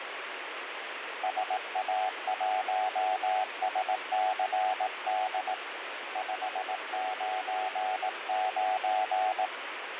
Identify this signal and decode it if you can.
Morse code, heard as a keyed tone, hand-sent with a paddle, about 18 wpm, 750 Hz, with radio static. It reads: SA1SCD 599